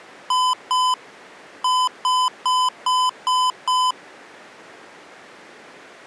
Beep code, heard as beeps from a small speaker, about 1010 Hz. 2-6.